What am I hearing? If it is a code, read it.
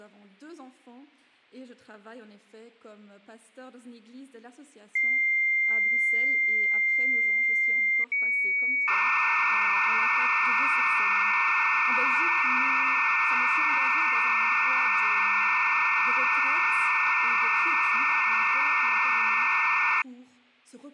Dial-up modem handshake (low-speed, two carriers), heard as two whistles, then hiss.